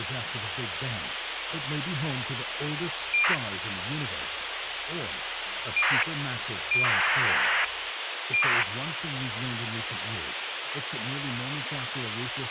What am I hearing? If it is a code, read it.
ACARS aircraft data, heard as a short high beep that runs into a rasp, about 2400 baud, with radio hiss.